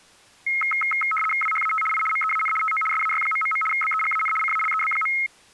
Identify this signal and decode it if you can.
RTTY (75 baud, 850 Hz shift), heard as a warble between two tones, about 1700 Hz centre. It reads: WHAT I MEAN TO SAY... BEGAN CALEB.